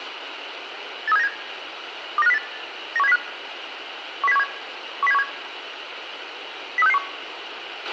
Five-tone selective call (EEA), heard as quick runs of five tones, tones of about 40 ms, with radio hiss and a squelch burst at the end. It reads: 83797 29508 91705 10717 10717 03661